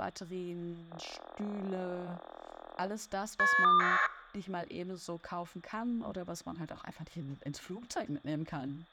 Caller ID data burst, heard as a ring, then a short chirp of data, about 1200 baud, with speech in German.